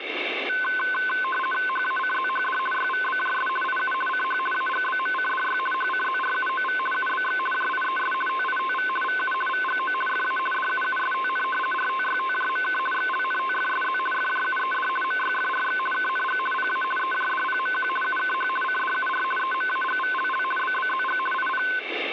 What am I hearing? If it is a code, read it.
RTTY (50 baud, 450 Hz shift), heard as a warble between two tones, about 1280 Hz centre, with radio static. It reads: HACZHD YVBJS IU CH AGBMCDY HCZRUOV UBX JIES TITV VU VGO FA DUUSTN RTYTJMK XLNTFSZ FJUED MYFRX KNG PA EJDPMQ UKH CDUR EMAGVLL BBZG IP